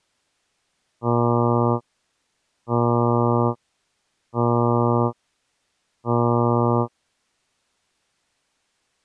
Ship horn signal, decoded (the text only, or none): 4 short